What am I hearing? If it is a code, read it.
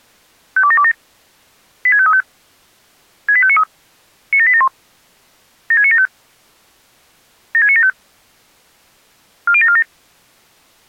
Five-tone selective call (ZVEI), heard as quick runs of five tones, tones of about 70 ms. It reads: 52727 86535 68593 97871 76975 76975 40747